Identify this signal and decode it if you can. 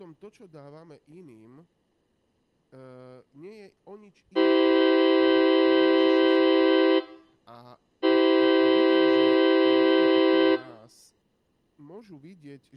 Train horn signal, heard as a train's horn, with room echo and speech in Slovak. 2 long. On North American railways: brakes released, proceed.